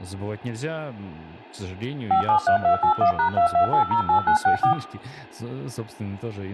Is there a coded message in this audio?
Yes: DTMF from 2.1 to 4.7 s, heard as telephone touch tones, dialled by machine, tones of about 100 ms, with room echo and speech in Russian. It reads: 573281#22808964